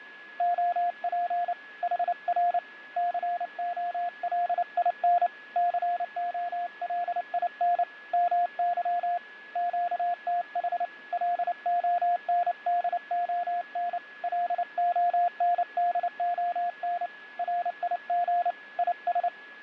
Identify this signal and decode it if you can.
Morse code, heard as a keyed tone, hand-sent with a paddle, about 29 wpm, 700 Hz, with fading and a steady whistle near 1690 Hz. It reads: OP HR COLIN COLIN MY QTH LONDON LONDON RIG IS